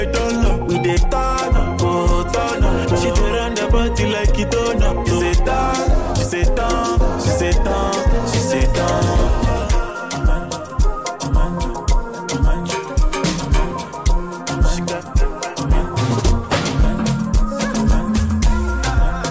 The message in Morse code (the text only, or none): none